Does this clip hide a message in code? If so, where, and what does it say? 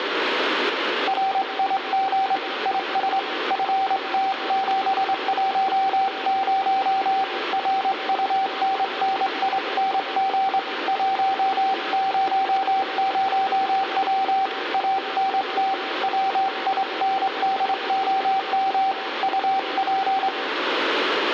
Yes: Morse code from 1.0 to 20.3 s, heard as a keyed tone, hand-sent with a straight key, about 24 wpm, 770 Hz, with radio static and room echo. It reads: RIG IS FT710 RUNNING 100W ANT WINDOM UP